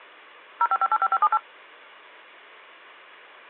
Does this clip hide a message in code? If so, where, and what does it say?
Yes: DTMF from 0.6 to 1.4 s, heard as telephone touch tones, dialled by machine, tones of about 50 ms. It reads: 05585578